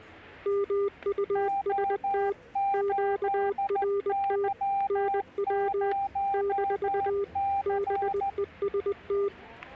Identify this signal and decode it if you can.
Morse code, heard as two keyed tones, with static crashes and the noise of a crowd indoors. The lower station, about 20 wpm, 400 Hz: MUST QRT NW - BEST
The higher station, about 14 wpm, 790 Hz: O8Y0C